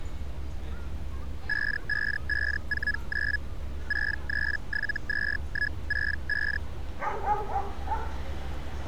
Hellschreiber (Feld-Hell, 122.5 baud), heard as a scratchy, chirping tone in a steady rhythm, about 1700 Hz, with street noise. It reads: 55549 6372165